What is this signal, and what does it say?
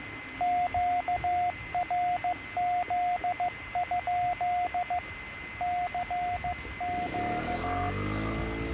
Morse code, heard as a keyed tone, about 15 wpm, 720 Hz, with radio static, a steady whistle near 2050 Hz and street noise. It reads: QRZ? CQ